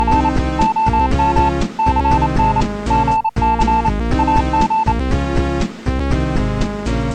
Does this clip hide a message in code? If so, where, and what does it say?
Yes: Morse code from 0.0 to 5.0 s, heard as a keyed tone, machine-sent, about 28 wpm, 880 Hz. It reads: … OM CN GC AG